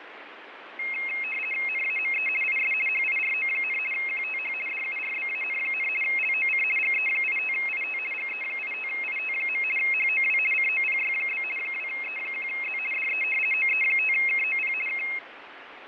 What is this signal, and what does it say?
RTTY (50 baud, 450 Hz shift), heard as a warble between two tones, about 2350 Hz centre, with radio static and fading. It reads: NAME IS HIRO, QTH DURBAN, LOC GE85IT GE85IT. HOW COPY? 2E1Z DE OE5KOP K